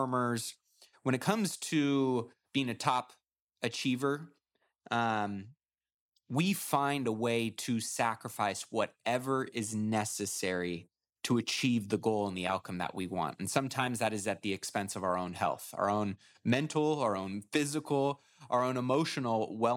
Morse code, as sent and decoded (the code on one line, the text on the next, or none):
none